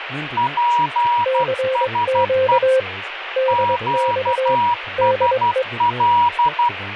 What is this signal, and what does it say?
Morse code, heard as two keyed tones, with radio static and speech in English. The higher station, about 12 wpm, 960 Hz: PSE QSL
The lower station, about 22 wpm, 520 Hz: CQ DX DE